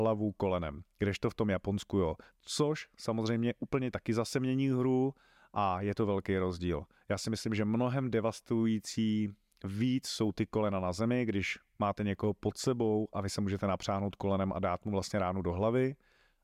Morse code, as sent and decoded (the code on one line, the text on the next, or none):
none